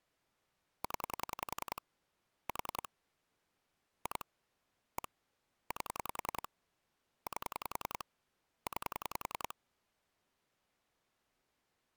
Pulse dialling, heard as clicks on a phone line, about 10 pulses a second. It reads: 0 4 2 1 8 8 9